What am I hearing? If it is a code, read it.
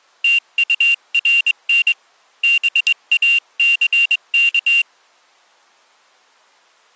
Morse code, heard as a high beeper, hand-sent with a straight key, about 23 wpm, 2750 Hz. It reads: TURN BACK